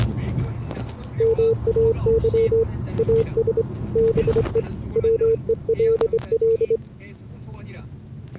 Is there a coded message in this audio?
Yes: Morse code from 1.1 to 6.8 s, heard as a keyed tone, hand-sent with a straight key, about 24 wpm, 450 Hz, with the noise inside a car. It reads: MAY AS BE WELL